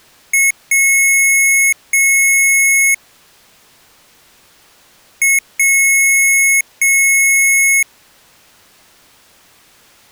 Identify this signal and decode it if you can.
Beep code, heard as beeps from a small speaker, played twice, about 2200 Hz. 1 short, 2 long.